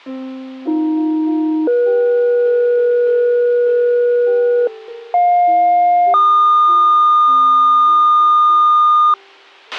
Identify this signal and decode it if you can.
Two-tone page, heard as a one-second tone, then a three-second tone, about 310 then 480 Hz, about 710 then 1220 Hz, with a squelch burst at the end.